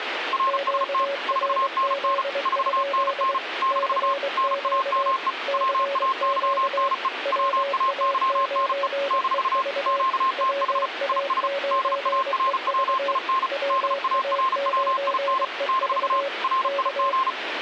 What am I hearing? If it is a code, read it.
Morse code, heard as two keyed tones, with radio static. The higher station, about 35 wpm, 1060 Hz: RST 4NN 4NN - NAME WAYNE WAYNE - QTH IS DARWIN DARWIN - RIG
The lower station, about 23 wpm, 560 Hz: QRZ? CQ CQ WA9EV WA9EV WA9EV K